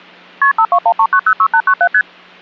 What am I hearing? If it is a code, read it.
Multi-frequency trunk signalling (R1, as on North American trunks), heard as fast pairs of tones, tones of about 70 ms. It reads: KP 5213906897 ST